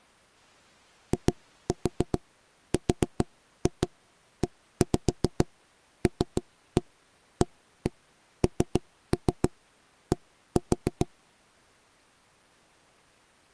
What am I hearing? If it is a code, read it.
Tap code, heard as knocks on wood, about 7 knocks a second. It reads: IRELAND